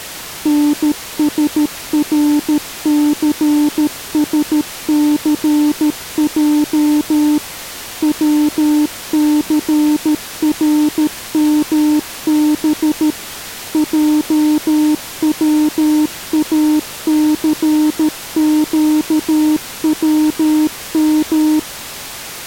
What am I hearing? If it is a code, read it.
Morse code, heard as a keyed tone, machine-sent, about 13 wpm, 300 Hz. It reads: NSRCSCJ WCRMB JWACQWM